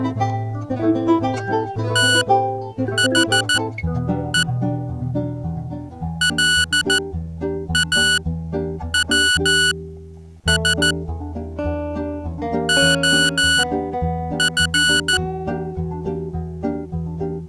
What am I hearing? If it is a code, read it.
Morse code, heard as electronic beeps, machine-sent, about 14 wpm, spaced as for 8 wpm, 1470 Hz. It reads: THE LAWS OF